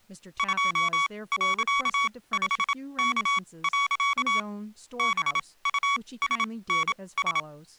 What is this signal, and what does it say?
Morse code, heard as electronic beeps, machine-sent, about 27 wpm, spaced as for 20 wpm, 1120 Hz, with speech in English. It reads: 2.5K. BUSNS